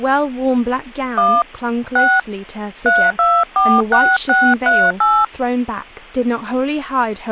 DTMF, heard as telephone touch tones, dialled by hand, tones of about 240 ms, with speech in English. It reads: 1 6 3246638